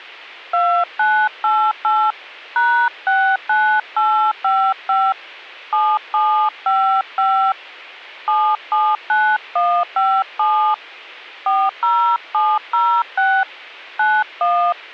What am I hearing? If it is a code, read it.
DTMF, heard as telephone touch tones, dialled by hand, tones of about 290 ms. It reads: 2988 #69855 7755 779157 40706 91